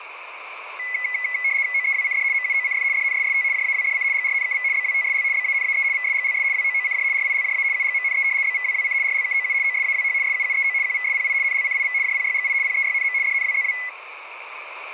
RTTY (75 baud, 170 Hz shift), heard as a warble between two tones, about 2100 Hz centre. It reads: OEWCD MUOCF DNSST JAWDC GRNKV BWTSL BANAE VSGLS WOOCJ RILJA UGMNE BVWWC RLKOU OSAWH SUUEO QVSPI NLCIV JPYGI PEYNM DNWZW